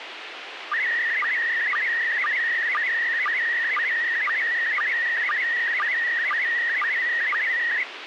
SSTV (slow-scan television), PD 120, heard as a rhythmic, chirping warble, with radio hiss and a squelch burst at the end.